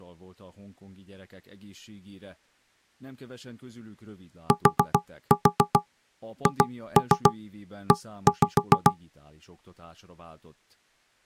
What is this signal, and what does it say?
Tap code, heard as knocks on wood, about 7 knocks a second, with speech in Hungarian. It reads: THE